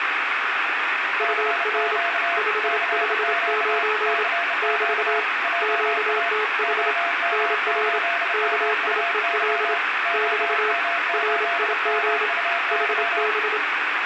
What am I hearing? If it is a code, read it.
Morse code, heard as two keyed tones, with radio static. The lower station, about 27 wpm, 430 Hz: UR 559 <BT> QTH NR KIEL <BT> RIG HB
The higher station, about 31 wpm, 690 Hz: CQ CQ CQ JA OM8MUY OM8MUY